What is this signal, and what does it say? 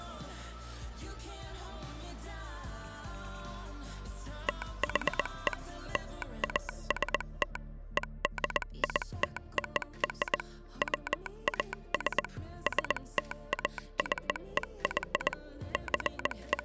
Morse code (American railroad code), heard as a telegraph sounder, machine-sent. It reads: THE LAST EDITOR WAS STACEY …